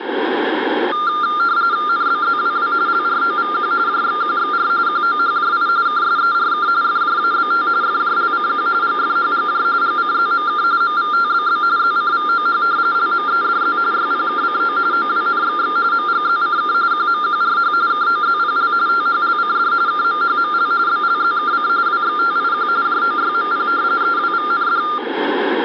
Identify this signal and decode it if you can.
RTTY (45.45 baud, 170 Hz shift), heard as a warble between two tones, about 1300 Hz centre, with radio static. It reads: NBZWW LROVQ JXQXR QOHJI KSERK FJABT FJLCQ GFHGJ GCZMK MVTBB ZCVOH LMEDZ YPKCO OWNXX MGZCK QMQRH KOZPL THLCD KMHML BLZKC WXTIQ JOYMP EWVND